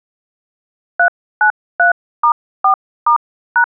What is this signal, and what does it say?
DTMF, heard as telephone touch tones, dialled by hand, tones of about 100 ms. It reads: 393*4*#